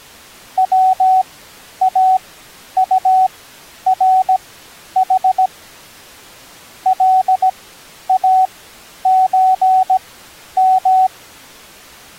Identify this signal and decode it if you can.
Morse code (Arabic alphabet), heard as a keyed tone, machine-sent, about 17 wpm, spaced as for 10 wpm, 750 Hz. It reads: واطرح لازم